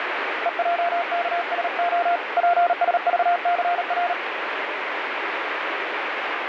Morse code, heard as a keyed tone, hand-sent with a paddle, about 38 wpm, 700 Hz, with radio static. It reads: EJKSO PSVCR